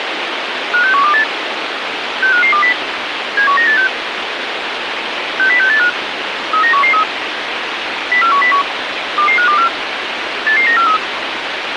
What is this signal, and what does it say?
Five-tone selective call (CCIR), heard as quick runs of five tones, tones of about 100 ms, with radio hiss. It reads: 56128 65520 71986 60685 39113 04101 22524 88943